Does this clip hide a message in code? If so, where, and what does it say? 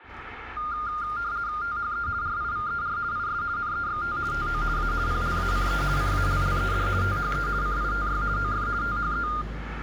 Yes: RTTY (50 baud, 170 Hz shift) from 0.6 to 9.4 s, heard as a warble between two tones, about 1310 Hz centre, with radio static, room echo and the noise of a residential street. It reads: THE RIVER IS NEXT TO A PLACE CALLED THE CITY OF THE